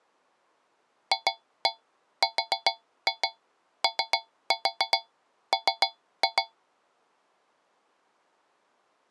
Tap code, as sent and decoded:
2-1 4-2 3-4 3-2
FROM

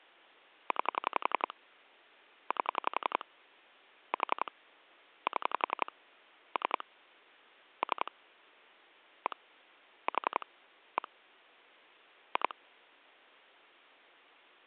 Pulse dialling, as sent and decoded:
9 / 8 / 4 / 7 / 3 / 3 / 1 / 4 / 1 / 2
9 8 4 7 3 3 1 4 1 2

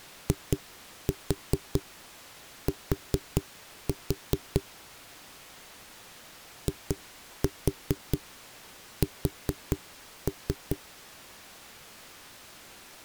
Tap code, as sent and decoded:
2-4 4-4 / 2-4 4-3
IT IS

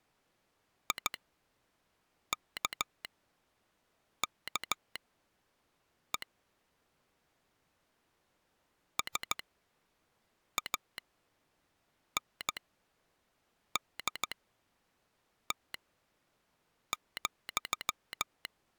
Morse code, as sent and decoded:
.. -.- -.- . / ... .- -. -.. - --..--
IKKE SANDT,

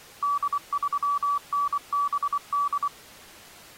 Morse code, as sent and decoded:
-.. ...-- -. -... -..
D3NBD

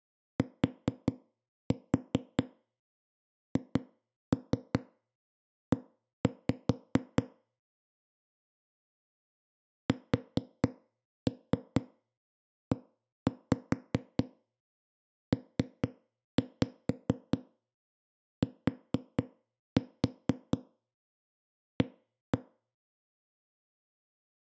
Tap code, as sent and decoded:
4-4 2-3 1-5 / 4-3 1-5 3-5 4-4 1-1
THE SEPTA

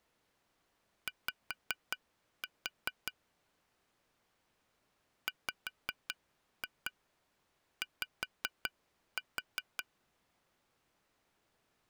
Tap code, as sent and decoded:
5-4 / 5-2 5-4
Y WY

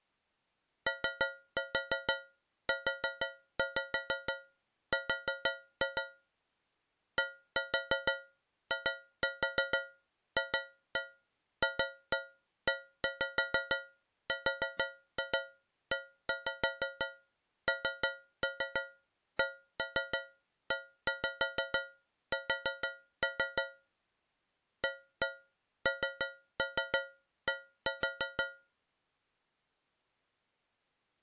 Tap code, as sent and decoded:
3-4 4-5 4-2 / 1-4 2-4 2-1 2-1 1-5 4-2 1-5 3-3 1-3 1-5 4-3 / 1-1 3-3 1-4
OUR DIFFERENCES AND

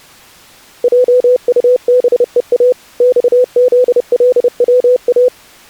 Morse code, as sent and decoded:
.--- ..- -... . .- / -..- --.. .-.. .-- .-
JUBEA XZLWA

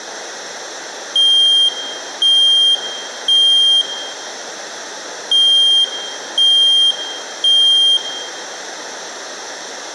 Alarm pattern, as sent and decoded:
3 beeps and a pause
temporal three

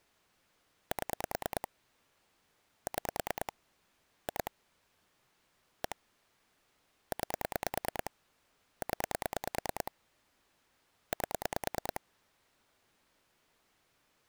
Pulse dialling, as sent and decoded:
7 / 6 / 2 / 1 / 9 / 10 / 8
7 6 2 1 9 0 8

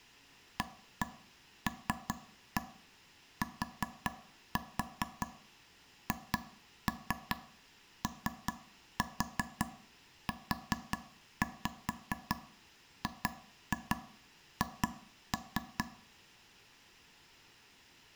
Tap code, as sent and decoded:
1-1 3-1 4-4 2-3 3-4 4-5 2-2 2-3
ALTHOUGH

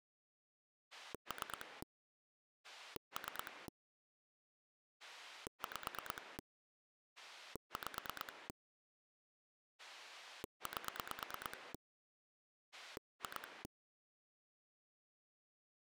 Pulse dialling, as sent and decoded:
3 / 3 / 5 / 5 / 8 / 2
3 3 5 5 8 2

